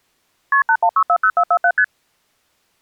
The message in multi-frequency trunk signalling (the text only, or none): KP 81640447 ST